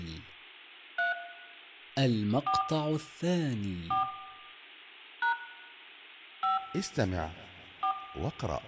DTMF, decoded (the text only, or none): 3 4 4 # 5 4